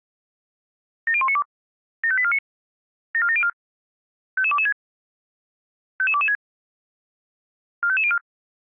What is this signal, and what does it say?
Five-tone selective call (ZVEI), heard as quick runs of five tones, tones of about 70 ms. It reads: 70192 75849 74704 55226 55226 45504